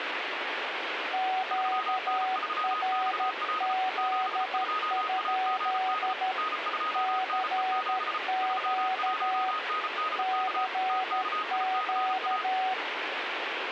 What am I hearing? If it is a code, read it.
Morse code, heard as two keyed tones, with radio static. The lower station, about 13 wpm, 750 Hz: QRZ? CQ CQ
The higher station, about 34 wpm, 1260 Hz: 3N3XL 72AGD N2NE7 31NDK TKICA